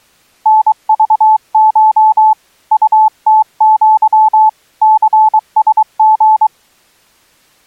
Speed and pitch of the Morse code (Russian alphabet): 23 wpm, 870 Hz

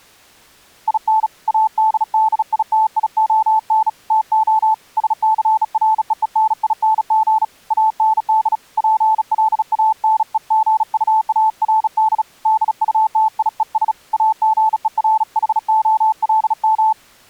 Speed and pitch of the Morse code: 36 wpm, 880 Hz

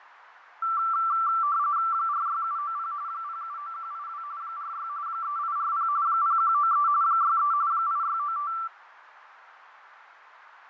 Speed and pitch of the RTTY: 45.45 baud, 170 Hz shift, 1250 Hz centre

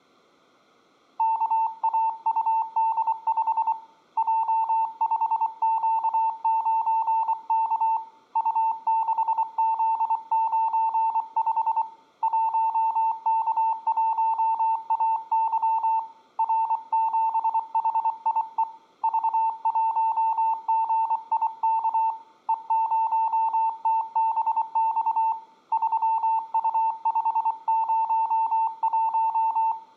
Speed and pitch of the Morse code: 24 wpm, 900 Hz

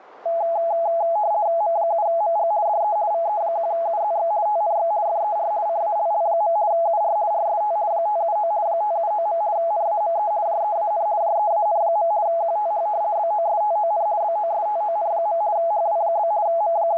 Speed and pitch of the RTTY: 50 baud, 170 Hz shift, 760 Hz centre

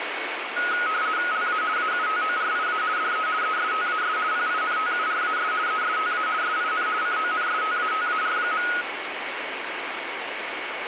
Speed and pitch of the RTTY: 50 baud, 170 Hz shift, 1360 Hz centre

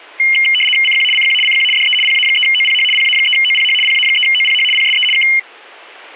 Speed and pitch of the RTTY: 75 baud, 850 Hz shift, 2550 Hz centre

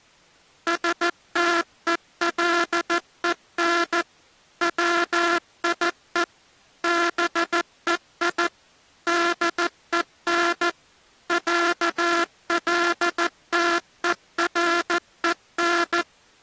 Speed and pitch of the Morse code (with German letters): 14 wpm

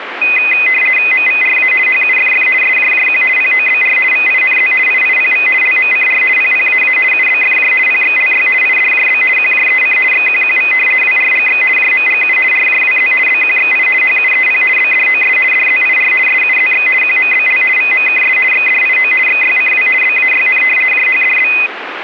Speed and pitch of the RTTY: 50 baud, 450 Hz shift, 2250 Hz centre

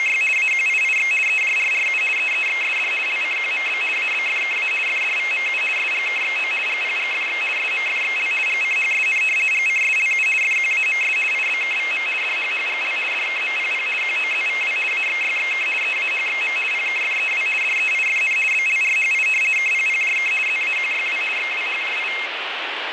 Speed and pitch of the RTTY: 50 baud, 450 Hz shift, 2350 Hz centre

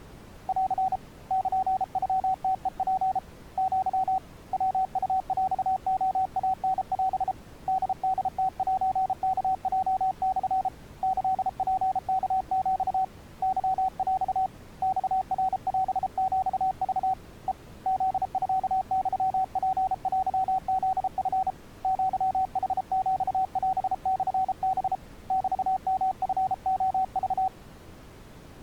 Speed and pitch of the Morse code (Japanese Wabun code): 33 wpm, 760 Hz

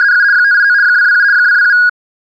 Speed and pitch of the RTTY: 75 baud, 170 Hz shift, 1550 Hz centre

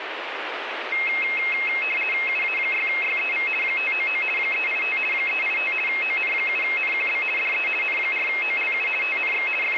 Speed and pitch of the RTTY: 50 baud, 450 Hz shift, 2350 Hz centre

